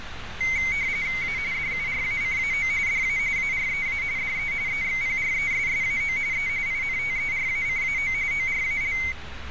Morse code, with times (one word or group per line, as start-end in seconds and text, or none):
none